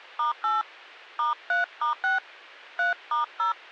DTMF, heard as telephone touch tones, dialled by hand, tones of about 150 ms. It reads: *8 *3*6 3*0